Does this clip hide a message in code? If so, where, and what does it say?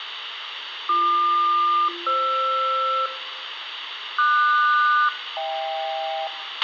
Yes: aircraft SELCAL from 0.9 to 6.3 s, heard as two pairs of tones, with radio hiss and a squelch burst at the end. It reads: BQ-FR QS-HK